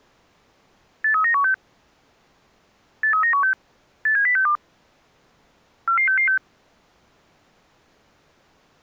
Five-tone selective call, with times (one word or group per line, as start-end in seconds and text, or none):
1.0-1.5 83916
3.0-3.5 83916
4.1-4.6 87062
5.9-6.4 44666